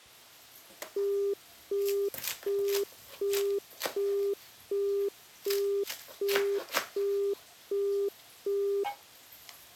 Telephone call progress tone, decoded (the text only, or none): busy tone